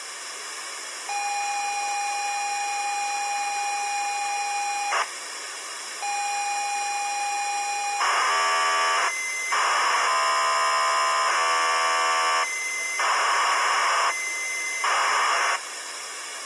ZX Spectrum tape loading, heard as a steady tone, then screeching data, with tape hiss.